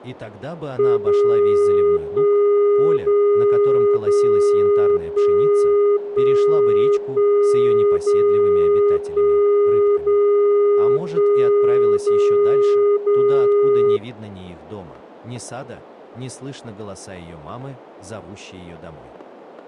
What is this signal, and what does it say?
Radio time signal (DCF77), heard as a tone whose level steps once a second, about 410 Hz. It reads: 0 1 0 0 1 1 1 0 1 0 1 0 0